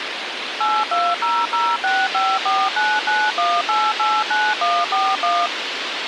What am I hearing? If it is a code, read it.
DTMF, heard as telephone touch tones, dialled by machine, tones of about 230 ms, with radio hiss. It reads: 8200654991889141